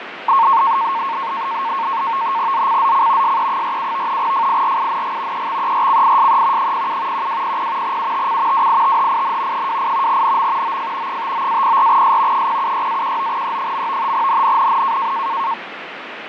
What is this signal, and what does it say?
NAVTEX (SITOR-B), 100 baud, 170 Hz shift, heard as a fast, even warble, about 1000 Hz centre, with radio static and fading. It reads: ZCZC SE47 FIRING EXERCISE 07 1200 UTC WITHIN 28 NM OF 59-04S 076-19E. NNNN